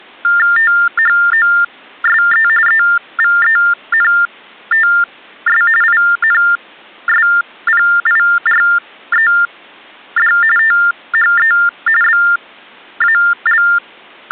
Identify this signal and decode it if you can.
TTY/TDD text telephone tones (45.45 baud Baudot), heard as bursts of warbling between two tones, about 400 Hz shift, 1600 Hz centre. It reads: THOSE EVENTS INSPIRED THE …